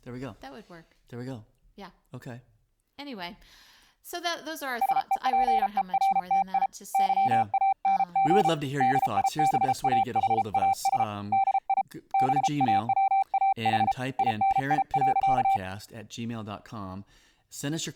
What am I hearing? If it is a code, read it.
Morse code, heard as a keyed tone, hand-sent with a paddle, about 33 wpm, 780 Hz, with speech in English. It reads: SEPERTI YANG DIBAHAS DI BAWAH INI.